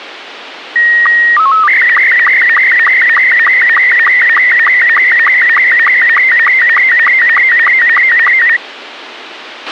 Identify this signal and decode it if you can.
SSTV (slow-scan television), Robot 72, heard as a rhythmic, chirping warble, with radio hiss and a squelch burst at the end.